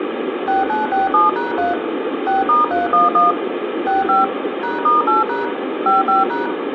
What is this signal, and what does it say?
DTMF, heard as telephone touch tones, dialled by machine, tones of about 160 ms, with phone line noise and room echo. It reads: 6967#3 6*311 65 #*8# 55#